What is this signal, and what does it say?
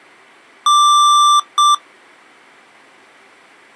Beep code, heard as beeps from a small speaker, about 1180 Hz. 1 long, 1 short. In IBM BIOS tables: system board problem.